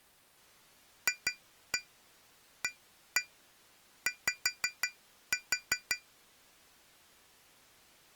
Tap code, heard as taps on glass, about 5 knocks a second. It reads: FAY